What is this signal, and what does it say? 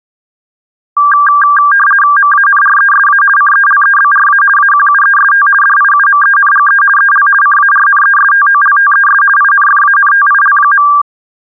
RTTY (50 baud, 450 Hz shift), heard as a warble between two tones, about 1390 Hz centre. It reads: MANRESA CELEBRA AQUEST DIUMENGE EL CARNESTOLTES INFANTIL.